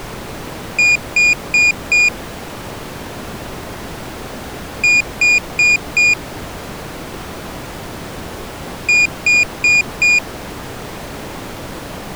Beep code, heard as a piezo beeper, played three times, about 2450 Hz. 4 short. In AMI BIOS tables: system timer failure; in Dell tables: memory read or write failure.